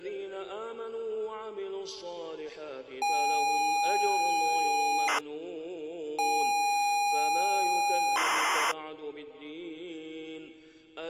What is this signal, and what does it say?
ZX Spectrum tape loading, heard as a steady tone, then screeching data.